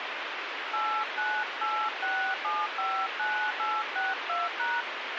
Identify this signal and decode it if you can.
DTMF, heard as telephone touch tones, dialled by hand, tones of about 270 ms, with radio hiss and a squelch burst at the end. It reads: 8986759862#